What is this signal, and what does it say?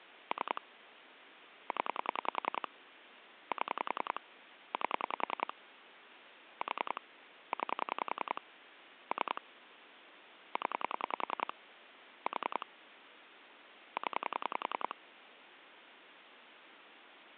Pulse dialling, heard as clicks on a phone line, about 10 pulses a second, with phone line noise. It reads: 3 0 7 8 4 9 3 0 4 0